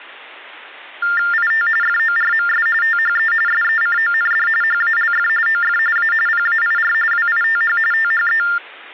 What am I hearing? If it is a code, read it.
TTY/TDD text telephone tones (45.45 baud Baudot), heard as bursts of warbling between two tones, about 400 Hz shift, 1600 Hz centre. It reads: IT FORMS THE SECOND HALF OF A PAIR WITH THE